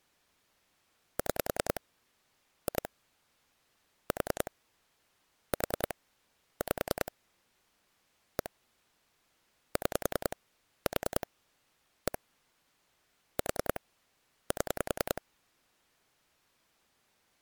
Pulse dialling, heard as clicks on a phone line, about 10 pulses a second. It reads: 6 2 4 4 5 1 6 4 1 4 7